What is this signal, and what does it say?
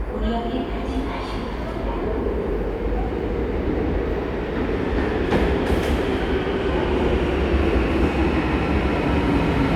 The noise of a subway station. There is no code.